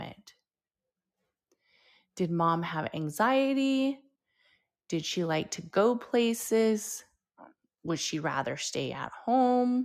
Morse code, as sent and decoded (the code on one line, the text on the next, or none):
none